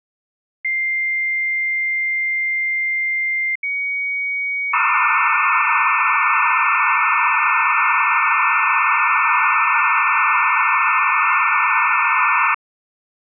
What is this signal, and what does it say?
Dial-up modem handshake (low-speed, two carriers), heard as two whistles, then hiss.